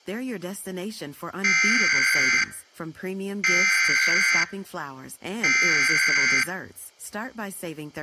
Emergency Alert System (SAME) tones (header bursts), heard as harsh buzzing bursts, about 520.83 baud, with speech in Filipino.